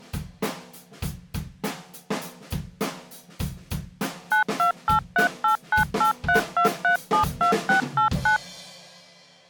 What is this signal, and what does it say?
DTMF, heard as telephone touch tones, dialled by machine, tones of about 110 ms. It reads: 928389832372689